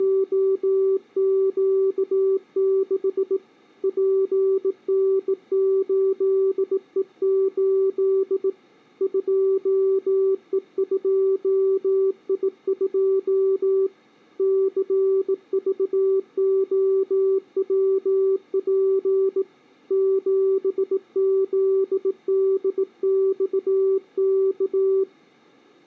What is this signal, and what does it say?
Morse code, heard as a keyed tone, hand-sent with a bug key, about 18 wpm, 380 Hz. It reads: … PN8E8 2E2I2 CVOWP 7ZDXK